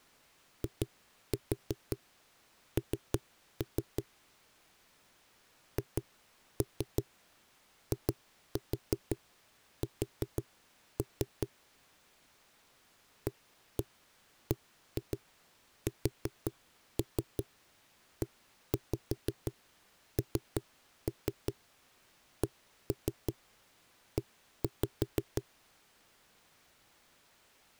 Tap code, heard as knocks on a wall, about 5 knocks a second. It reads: IN HIS ABSENCE